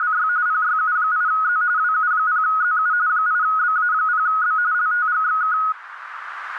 RTTY (45.45 baud, 170 Hz shift), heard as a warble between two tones, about 1360 Hz centre, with radio static and a narrow filter. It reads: … PYU8Z WU0ZU 8BA0B LTGXK